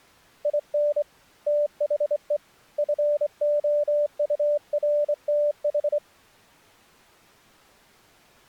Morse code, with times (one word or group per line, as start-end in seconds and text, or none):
0.5-1.0 IN
1.5-2.4 THE
2.8-6.0 FOURTH